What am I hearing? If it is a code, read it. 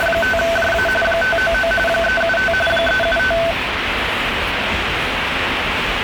RTTY (45.45 baud, 850 Hz shift), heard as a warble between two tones, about 1090 Hz centre, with radio static and the noise of a subway station. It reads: … 599 375 375